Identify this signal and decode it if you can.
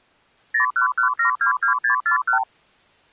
Multi-frequency trunk signalling (R2, with the far end's replies), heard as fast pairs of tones, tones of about 110 ms. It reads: 011722641